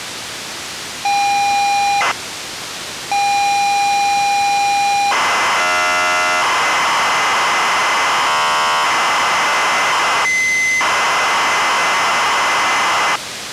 ZX Spectrum tape loading, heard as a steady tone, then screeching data, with tape hiss.